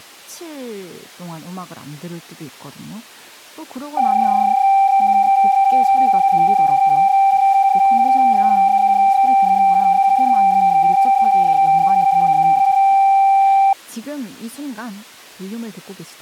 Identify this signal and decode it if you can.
PSK31 (31.25 baud), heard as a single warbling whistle, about 780 Hz, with speech in Korean.